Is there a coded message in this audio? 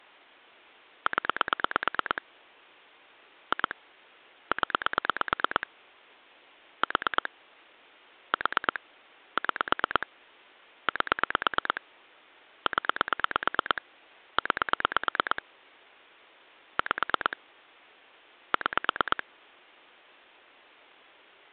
Yes: pulse dialling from 1.1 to 19.2 s, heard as clicks on a phone line, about 9 pulses a second. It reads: 0 2 0 4 4 6 8 0 9 5 6